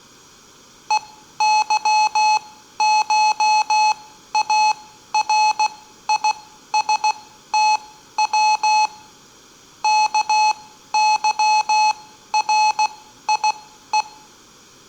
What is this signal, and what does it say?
Morse code (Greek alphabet), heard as electronic beeps, machine-sent, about 16 wpm, spaced as for 12 wpm, 860 Hz, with room echo. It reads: ΕΥΧΑΡΙΣΤΩ ΚΥΡΙΕ